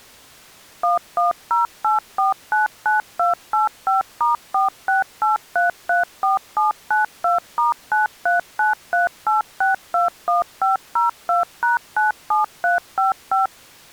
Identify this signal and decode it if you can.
DTMF, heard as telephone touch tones, dialled by machine, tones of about 140 ms. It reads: 1108499285*468334792*93938621502#97355